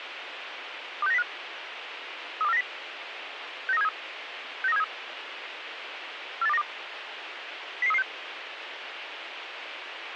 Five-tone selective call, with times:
1.0-1.2 26905
2.4-2.6 32490
3.7-3.9 69373
4.6-4.8 69373
6.4-6.6 48292
7.8-8.0 00336

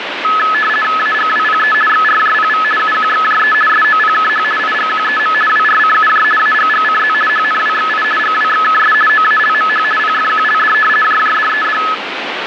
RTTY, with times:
1.0-1.7 AGWPE
1.9-2.6 XRJPV
2.8-3.5 UQXJE
3.7-4.4 SOPKH
4.6-5.3 IGQEM
5.5-6.2 WRCUJ
6.4-7.1 AGGCZ
7.3-8.0 HNWXI
8.2-8.9 GWXKS
9.1-9.8 OALMH
10.0-10.7 PFQLD
11.0-11.8 JJDED

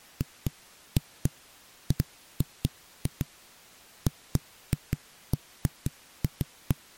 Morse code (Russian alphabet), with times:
none

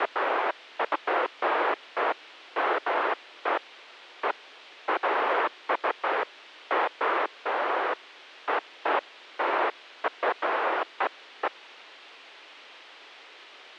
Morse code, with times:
none

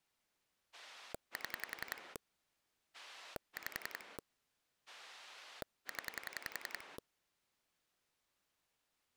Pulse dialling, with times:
0.7-2.2 7
2.9-4.2 5
4.9-7.0 0

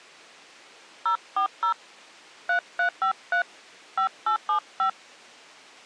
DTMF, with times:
1.1-1.7 040
2.5-3.4 3353
4.0-4.9 5875

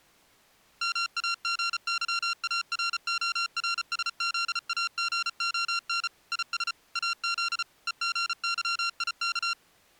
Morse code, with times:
0.8-6.1 MAGYARORSZAGON
6.3-6.7 IS
7.0-7.6 AZ
7.9-9.5 EGYIK

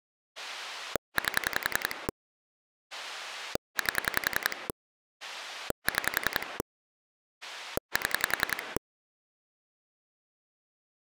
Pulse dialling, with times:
0.4-2.1 8
2.9-4.7 8
5.2-6.6 6
7.4-8.8 7

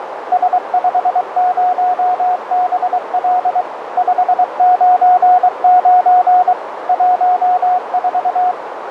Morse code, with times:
0.3-3.6 S50BL
4.0-6.5 599
6.9-8.5 14

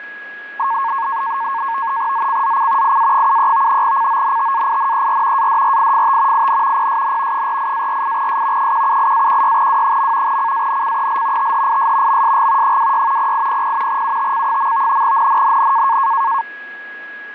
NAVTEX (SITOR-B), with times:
2.1-3.0 ZCZC
2.8-3.8 IA73
3.8-5.5 CONTAINER
5.4-6.5 ADRIFT
6.3-6.9 IN
6.8-7.5 PSN
7.3-8.7 48-48S
8.6-10.4 178-16W.
10.3-11.5 CANCEL
11.4-12.2 THIS
12.1-12.8 MSG
12.6-13.3 26
13.2-14.0 0800
13.9-15.0 UTC.
15.0-16.0 NNNN

